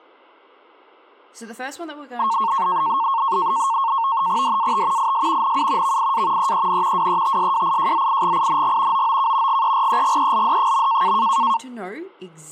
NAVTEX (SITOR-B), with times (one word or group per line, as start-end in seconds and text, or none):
4.4-5.1 DAT
5.0-5.6 IS
5.4-6.0 NU
5.8-6.5 VIA
6.4-7.1 EEN
7.0-9.1 WETSWIJZIGING
8.9-9.6 OOK
9.5-11.2 GEREGELD.